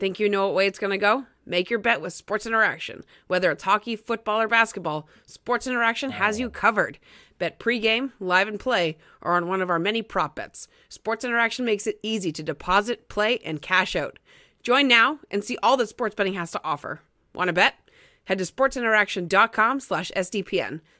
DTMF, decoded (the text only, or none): none